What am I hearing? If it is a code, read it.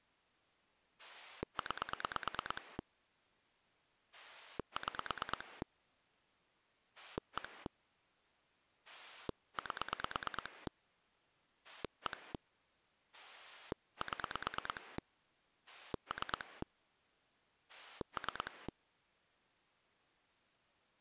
Pulse dialling, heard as a rotary dial, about 9 pulses a second. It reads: 9 6 1 8 1 7 3 3